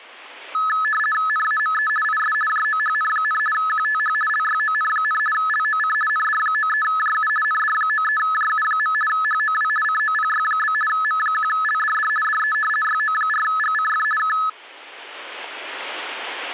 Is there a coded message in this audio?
Yes: RTTY (50 baud, 450 Hz shift) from 0.5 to 14.5 s, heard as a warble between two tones, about 1500 Hz centre. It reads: NAME IS JOHN, QTH LYON, LOC ND93JU ND93JU. HOW COPY? M1LDD DE YO4GCF K